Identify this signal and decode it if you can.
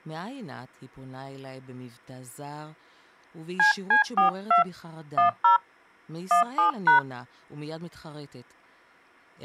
DTMF, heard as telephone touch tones, dialled by hand, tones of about 120 ms, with speech in Hebrew. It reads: CC42 10 17#